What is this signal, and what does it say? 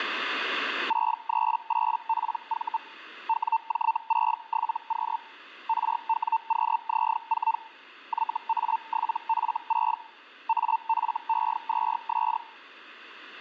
Hellschreiber (Feld-Hell, 122.5 baud), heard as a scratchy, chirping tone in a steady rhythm, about 900 Hz. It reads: 638PV WJ67Q RWQZ4 YA7F6 AFE2S